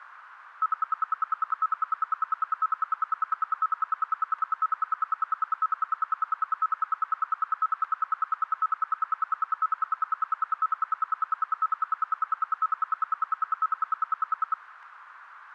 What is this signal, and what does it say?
Radio time signal (RWM, Moscow), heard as ten pulses a second, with static crashes.